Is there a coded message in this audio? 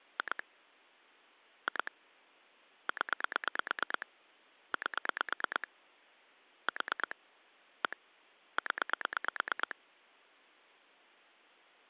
Yes: pulse dialling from 0.2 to 9.7 s, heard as clicks on a phone line, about 9 pulses a second. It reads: 2 2 0 8 4 1 0